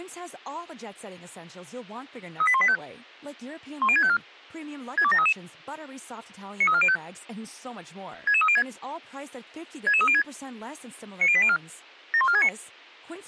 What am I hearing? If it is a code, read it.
Five-tone selective call (ZVEI), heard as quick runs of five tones, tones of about 70 ms, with speech in French. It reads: 38185 10654 62733 93405 66306 66306 90804 71469